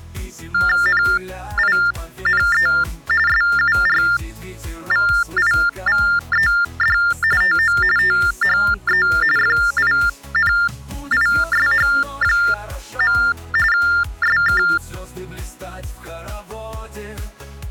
TTY/TDD text telephone tones (45.45 baud Baudot), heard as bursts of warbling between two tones, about 400 Hz shift, 1600 Hz centre. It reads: NINE SURVIVED TO THE FINISH. SK